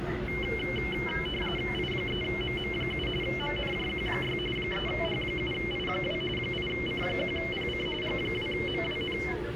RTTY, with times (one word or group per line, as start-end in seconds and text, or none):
1.7-3.1 I3MM7
3.2-4.4 MNJQ6
4.6-6.2 3H7I2
6.4-7.9 8C1PC
8.0-9.2 G2MWN